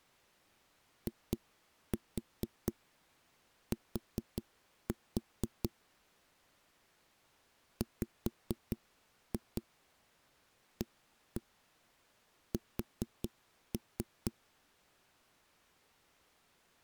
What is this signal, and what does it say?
Tap code, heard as knocks on a wall, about 4 knocks a second. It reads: IT WAS